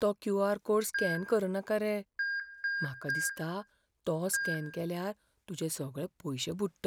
Beep code, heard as beeps, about 1600 Hz, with room echo and speech in Goan Konkani. 1-3-1. In Phoenix BIOS tables: memory refresh failure.